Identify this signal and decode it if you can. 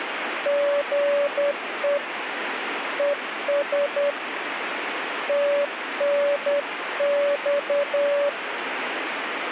Morse code, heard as a keyed tone, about 10 wpm, 570 Hz, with radio static. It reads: GE ES TNX